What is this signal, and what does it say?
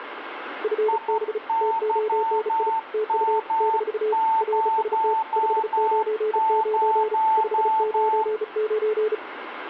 Morse code, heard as two keyed tones, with radio static and room echo. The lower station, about 35 wpm, 430 Hz: FB TONI TU - RST 599 599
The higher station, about 12 wpm, 890 Hz: IYM00